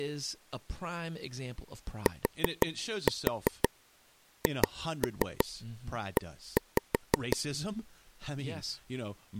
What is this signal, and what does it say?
Tap code, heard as taps on a table, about 5 knocks a second, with speech in English. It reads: THE